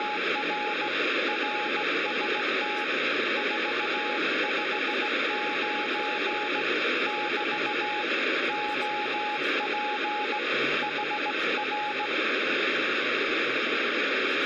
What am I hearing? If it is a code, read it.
Morse code, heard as a keyed tone, hand-sent with a straight key, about 17 wpm, 840 Hz, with heavy radio static and speech in Czech. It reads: … RST 459 <BT> OP HR